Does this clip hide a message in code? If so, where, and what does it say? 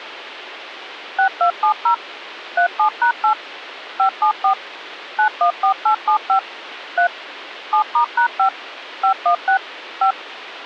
Yes: DTMF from 1.2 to 10.1 s, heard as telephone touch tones, dialled by machine, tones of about 100 ms, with phone line noise. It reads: 6270 37#8 574 914875 3 7*#5 516 5